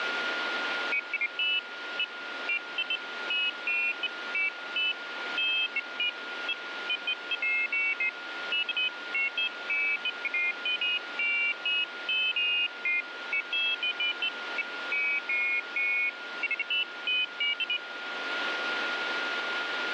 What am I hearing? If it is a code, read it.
Pairs of high tones at irregular times, with radio static and a steady whistle near 1420 Hz. There is no code.